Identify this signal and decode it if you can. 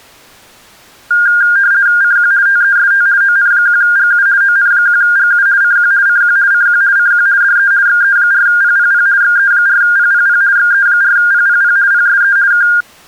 RTTY (50 baud, 170 Hz shift), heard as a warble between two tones, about 1500 Hz centre. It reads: CQ TEST ON1GU ON1GU CQ CQ CQ CQ DE XE4PPP XE4PPP XE4PPP PSE K